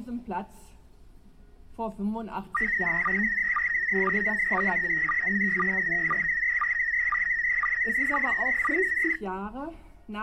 SSTV (slow-scan television), PD 120, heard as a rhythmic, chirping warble.